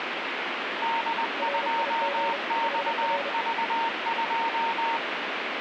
Morse code, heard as two keyed tones, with radio static. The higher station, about 20 wpm, 920 Hz: D2XV2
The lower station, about 31 wpm, 560 Hz: RIG HR